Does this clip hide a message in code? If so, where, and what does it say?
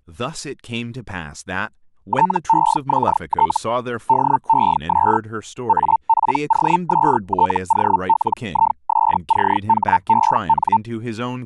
Yes: Hellschreiber (Feld-Hell, 122.5 baud) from 2.1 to 10.8 s, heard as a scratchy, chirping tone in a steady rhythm, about 900 Hz, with speech in English. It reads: TEXT DES APOSTOLISCHEN